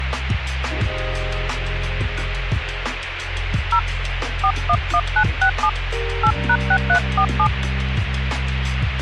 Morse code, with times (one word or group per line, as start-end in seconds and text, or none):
none